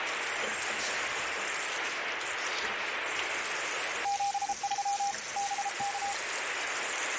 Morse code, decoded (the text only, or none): 73 BK